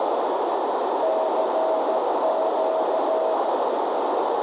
Morse code, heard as a keyed tone, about 14 wpm, 640 Hz, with heavy radio static and a narrow filter. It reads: CQ